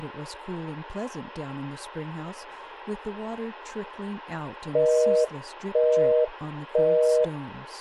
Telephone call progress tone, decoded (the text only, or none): busy tone